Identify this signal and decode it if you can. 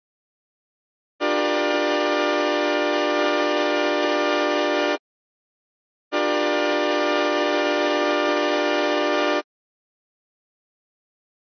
Train horn signal, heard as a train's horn. 2 long. On North American railways: brakes released, proceed.